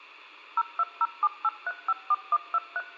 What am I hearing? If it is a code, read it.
DTMF, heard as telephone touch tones, dialled by machine, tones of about 40 ms. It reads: 02078354123